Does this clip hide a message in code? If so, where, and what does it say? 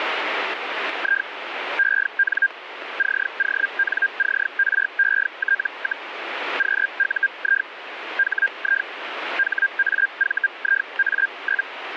Yes: Hellschreiber (Feld-Hell, 122.5 baud) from 1.0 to 11.7 s, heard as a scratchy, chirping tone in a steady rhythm, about 1600 Hz, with radio static. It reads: I EN CONCRET, QUI HI HAVIA?